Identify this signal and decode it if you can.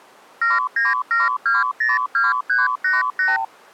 Multi-frequency trunk signalling (R2, with the far end's replies), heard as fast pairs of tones, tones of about 170 ms. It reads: 797202388